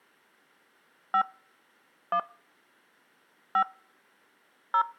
DTMF, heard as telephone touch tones, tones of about 80 ms. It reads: 5 1 5 0